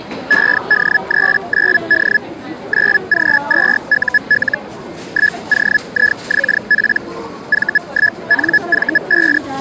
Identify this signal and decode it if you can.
Hellschreiber (Feld-Hell, 122.5 baud), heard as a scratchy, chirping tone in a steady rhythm, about 1700 Hz, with the noise of a crowd indoors. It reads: ED39D 9G2UL 1OIXP V1NV5